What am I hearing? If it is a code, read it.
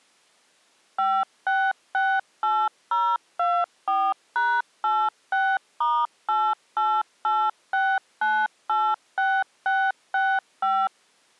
DTMF, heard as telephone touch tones, dialled by machine, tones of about 250 ms. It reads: 5668024#86*8886986665